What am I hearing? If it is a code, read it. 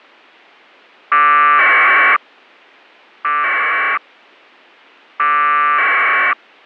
Packet radio (AX.25, as in APRS), 1200 baud, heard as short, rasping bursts.